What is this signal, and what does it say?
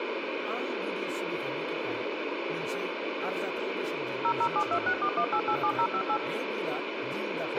DTMF, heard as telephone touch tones, dialled by machine, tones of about 70 ms, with radio hiss, a squelch burst at the end and speech in Bodo. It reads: 0072641887058